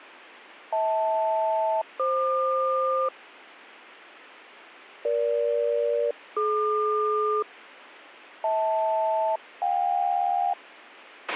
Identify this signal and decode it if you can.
Aircraft SELCAL, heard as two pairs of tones, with a squelch burst at the end. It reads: HL-FQ EG-DQ HL-JK